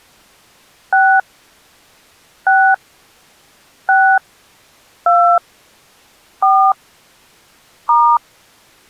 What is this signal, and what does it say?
DTMF, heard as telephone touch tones, dialled by hand, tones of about 240 ms. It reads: 6 6 6 2 4 *